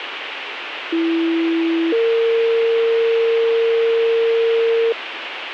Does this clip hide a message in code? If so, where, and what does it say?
Yes: two-tone page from 0.9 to 4.9 s, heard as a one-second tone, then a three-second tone, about 330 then 460 Hz, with radio hiss.